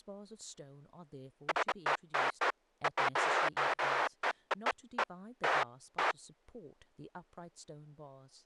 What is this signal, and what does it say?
Bursts of noise, with speech in English. There is no code.